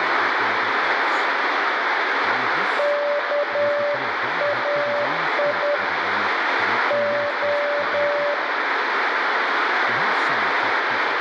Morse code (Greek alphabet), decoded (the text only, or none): ΚΑΙ Ο